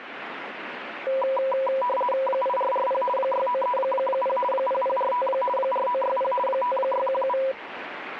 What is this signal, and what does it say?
RTTY (50 baud, 450 Hz shift), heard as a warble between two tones, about 760 Hz centre, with radio static. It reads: 8440 6930 0045 4960 5617